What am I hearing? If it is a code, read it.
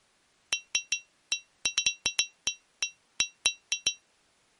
Irregular taps on glass. There is no code.